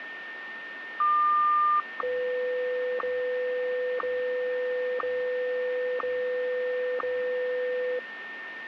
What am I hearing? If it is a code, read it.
Radio time signal (WWVH, Hawaii), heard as ticks, one a second, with radio static and a steady whistle near 1820 Hz.